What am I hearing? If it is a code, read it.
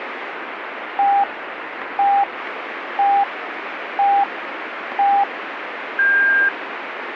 Radio time signal (five pips and a higher one, as on Chinese radio), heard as pips, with radio static.